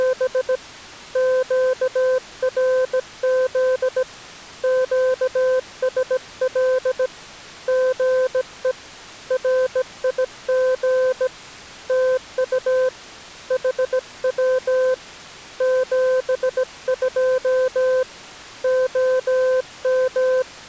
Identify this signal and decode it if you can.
Morse code, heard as a keyed tone, hand-sent with a bug key, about 17 wpm, 510 Hz. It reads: … QRZ QSL GE RIG TU HW 72 OM